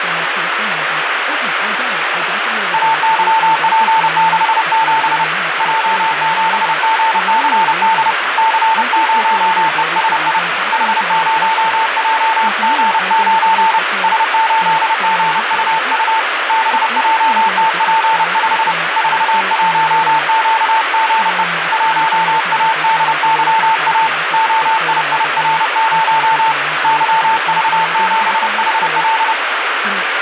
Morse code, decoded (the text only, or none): AYP67 J7GCD C0ESI H0JG9 S8GUU BJTP5 41QGE 1ADYA OIIR0 YV7HL